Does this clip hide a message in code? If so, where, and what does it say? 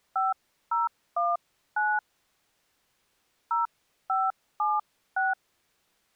Yes: DTMF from 0.2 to 5.3 s, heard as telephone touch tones, dialled by hand, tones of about 180 ms. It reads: 5019 0576